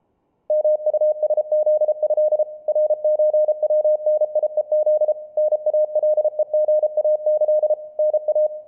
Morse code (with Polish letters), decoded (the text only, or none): MUSZĘ RÓWNIEZ NALEGAĆ NA